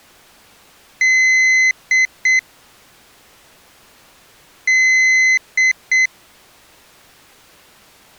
Beep code, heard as a piezo beeper, played twice, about 2050 Hz. 1 long, 2 short. In Award, IBM and AMI BIOS tables: video adapter failure.